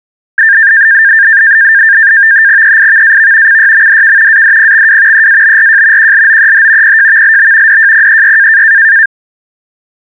NAVTEX (SITOR-B), 100 baud, 170 Hz shift, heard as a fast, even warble, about 1700 Hz centre. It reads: EIVAV CYMDK ADPXW EABRJ QLOEH PJVLB DJPEY